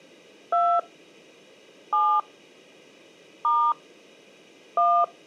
DTMF, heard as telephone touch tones, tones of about 270 ms. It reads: 2 7 * 1